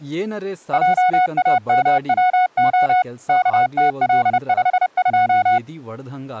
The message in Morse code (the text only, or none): JAMWO KTL52